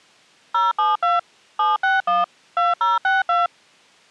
DTMF, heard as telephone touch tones, dialled by machine, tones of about 170 ms. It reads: 072 761 2062